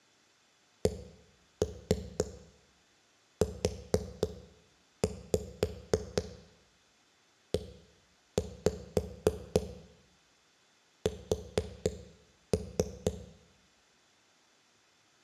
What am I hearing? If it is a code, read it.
Tap code, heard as knocks on a wall, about 4 knocks a second, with room echo. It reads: CUES